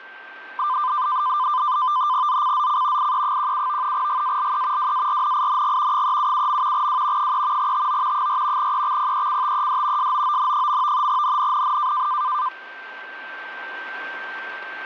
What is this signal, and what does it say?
NAVTEX (SITOR-B), 100 baud, 170 Hz shift, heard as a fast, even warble, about 1100 Hz centre, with static crashes and a steady whistle near 1560 Hz. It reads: ZCZC IE17 GALE WARNING 377. W 3 TO 4 EXPECTED SOON. NNNN